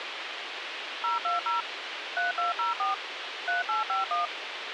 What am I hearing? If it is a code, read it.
DTMF, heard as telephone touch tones, dialled by machine, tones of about 150 ms, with radio hiss. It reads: 020 3204 3851